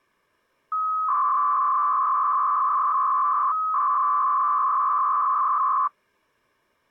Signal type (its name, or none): 300-baud modem data